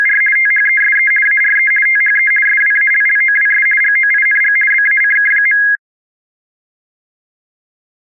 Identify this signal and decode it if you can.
RTTY (50 baud, 450 Hz shift), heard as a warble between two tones, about 1900 Hz centre. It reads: … THESE ARE THE SWALLOWS GOING BACK.